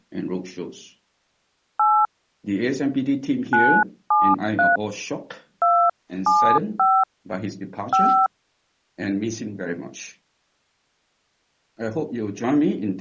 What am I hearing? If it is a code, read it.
DTMF, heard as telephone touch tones, dialled by hand, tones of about 250 ms. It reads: 8 973 275 5